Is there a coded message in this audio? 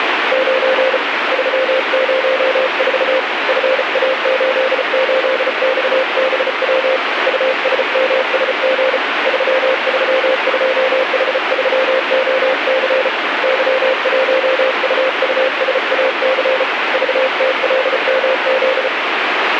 Yes: Morse code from 0.3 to 18.9 s, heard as a keyed tone, hand-sent with a paddle, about 34 wpm, 520 Hz, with radio static. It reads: 9 304 FA88XBW USMSG 332H3OC Y1UUSAC VTLMZ